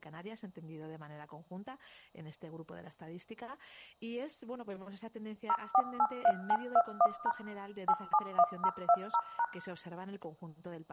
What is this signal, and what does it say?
DTMF, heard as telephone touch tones, dialled by machine, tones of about 60 ms. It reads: 0483921# 871020#